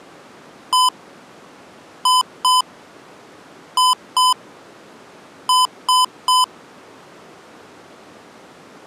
Beep code, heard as beeps from a small speaker, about 1010 Hz. 1-2-2-3. In Phoenix BIOS tables: BIOS ROM checksum failure.